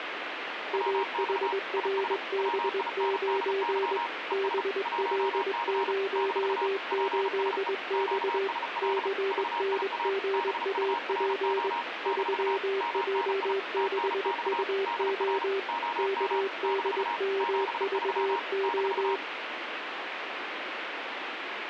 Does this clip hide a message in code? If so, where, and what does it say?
Yes: Morse code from 0.7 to 19.2 s, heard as two keyed tones, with radio static. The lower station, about 21 wpm, 390 Hz: AHRB9 BL08X CNGAP 3J6UO KDMVO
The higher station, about 35 wpm, 940 Hz: WX IS WINDY ES 1C - PSE QSL VIA BURO - MNI TNX DR OM - 73 -